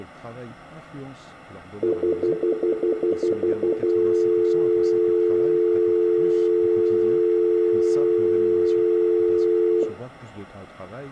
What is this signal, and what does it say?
Telephone call progress tone (North American plan), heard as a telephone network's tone, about 350, 440 Hz, 0.1 s on and 0.1 s off, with speech in French. Stutter dial tone.